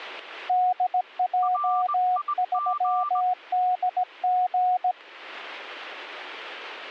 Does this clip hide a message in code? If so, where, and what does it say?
Yes: Morse code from 0.4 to 5.0 s, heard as two keyed tones. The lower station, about 17 wpm, 730 Hz: DJ3DG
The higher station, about 20 wpm, 1180 Hz: RIG